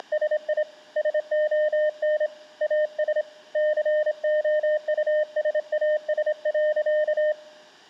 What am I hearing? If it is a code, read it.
Morse code, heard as a keyed tone, hand-sent with a straight key, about 27 wpm, 610 Hz, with room echo. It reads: … SON AS COUSAS.